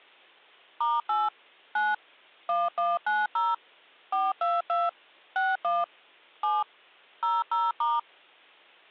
DTMF, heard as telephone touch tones, dialled by machine, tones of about 200 ms. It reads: *8 9 1190 422 61 7 00*